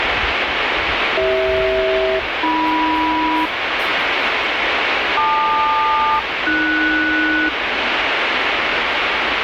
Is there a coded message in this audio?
Yes: aircraft SELCAL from 1.2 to 7.5 s, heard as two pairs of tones, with radio static and the noise inside a lift. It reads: CH-AM LQ-AS